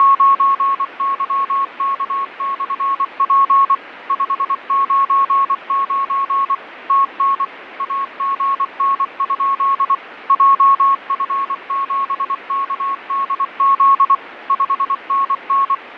Morse code, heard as a keyed tone, machine-sent, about 24 wpm, 1100 Hz, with radio static and fading. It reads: … 599 TN AGN? JF7KDZ 5NN